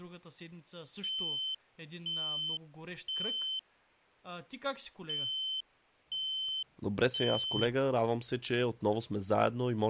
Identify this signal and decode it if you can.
Alarm pattern, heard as an alarm's beeps, played twice, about 3100 Hz, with speech in Bulgarian. Temporal three. Smoke or fire, evacuate.